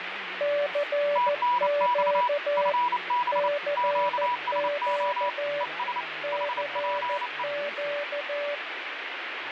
Morse code, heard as two keyed tones, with radio static and speech in English. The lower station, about 14 wpm, 580 Hz: CQ CQ CQ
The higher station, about 29 wpm, 980 Hz: TNX FB QSO ES HPE